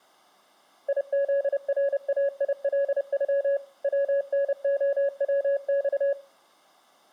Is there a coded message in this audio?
Yes: Morse code (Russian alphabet) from 0.8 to 6.2 s, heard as a keyed tone, machine-sent, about 30 wpm, 560 Hz, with room echo. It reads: ИЗРАИЛЮ ВНОВЬ